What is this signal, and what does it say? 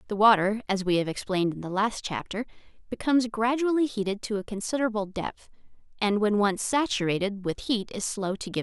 Speech in English. There is no code.